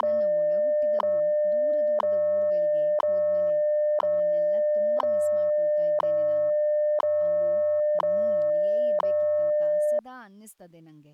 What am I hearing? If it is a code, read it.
Radio time signal (WWV, Colorado), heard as ticks, one a second, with speech in Kannada.